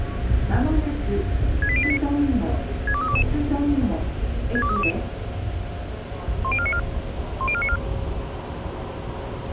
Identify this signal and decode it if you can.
Five-tone selective call (ZVEI), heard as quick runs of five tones, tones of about 70 ms, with the noise inside a subway train. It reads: 68089 62322 62322 10494 10494